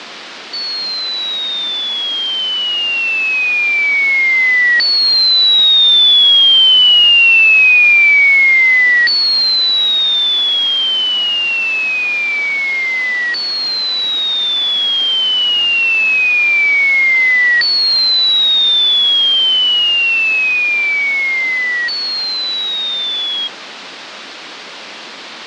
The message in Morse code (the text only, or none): none